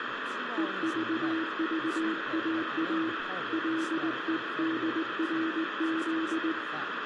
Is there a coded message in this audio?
Yes: Morse code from 0.5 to 6.6 s, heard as a keyed tone, hand-sent with a straight key, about 19 wpm, 320 Hz, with radio static, room echo and speech in English. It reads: EVVAA LEDRZ